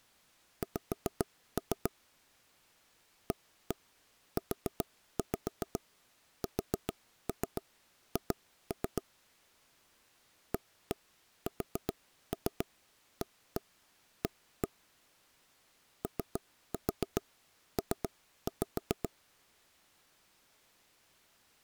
Tap code, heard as knocks on wood, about 7 knocks a second. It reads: X AUSH ASAA OP